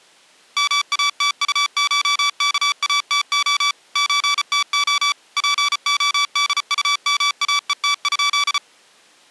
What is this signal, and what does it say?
Morse code (Russian alphabet), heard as electronic beeps, machine-sent, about 34 wpm, 1150 Hz. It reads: МАТУШКАТО ЧТО ПОДУМАЕТ?